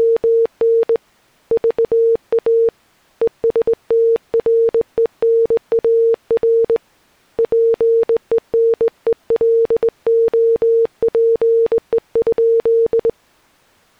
Morse code, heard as a keyed tone, hand-sent with a straight key, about 20 wpm, 460 Hz. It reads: … VA ESTRENAR PENELOPE?